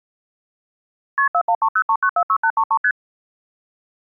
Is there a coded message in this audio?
Yes: multi-frequency trunk signalling (R1, as on North American trunks) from 1.2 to 2.9 s, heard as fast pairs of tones, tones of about 70 ms. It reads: KP 41303946833 ST